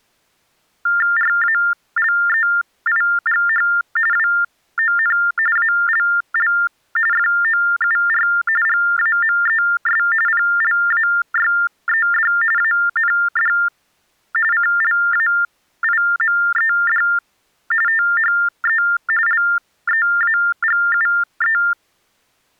TTY/TDD text telephone tones (45.45 baud Baudot), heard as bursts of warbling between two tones, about 400 Hz shift, 1600 Hz centre. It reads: RALEIGH WON ALL FOUR GAMES PLAYED AND CLAIMED THE LEAGUE